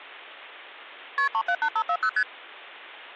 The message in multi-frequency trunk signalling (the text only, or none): KP 378540 ST